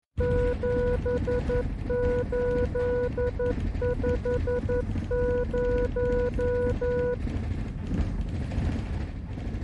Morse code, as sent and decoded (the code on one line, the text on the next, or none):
--... ---.. ..... -----
7850